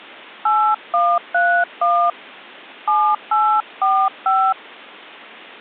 DTMF, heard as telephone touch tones, dialled by hand, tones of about 270 ms. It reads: 8131 7845